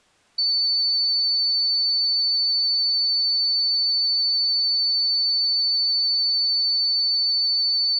A steady tone. There is no code.